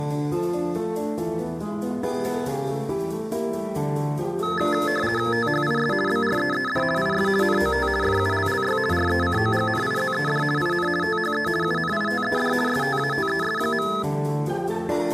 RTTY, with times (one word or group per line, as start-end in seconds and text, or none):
5.3-5.9 THIS
6.1-6.8 BREED
7.0-7.3 IS
7.4-7.9 NOT
8.0-8.8 FULLY
8.9-10.4 RECOGNIZED
10.6-10.9 IN
11.0-11.5 THE
11.6-12.5 UNITED
12.7-13.9 STATES.